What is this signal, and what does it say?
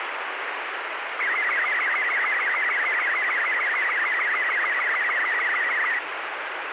SSTV (slow-scan television), Robot 36, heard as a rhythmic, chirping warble, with heavy radio static.